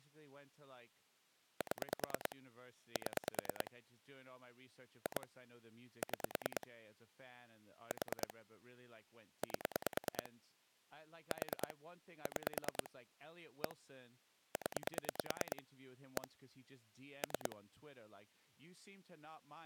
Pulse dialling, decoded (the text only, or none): 7 7 2 6 4 8 4 6 1 0 1 3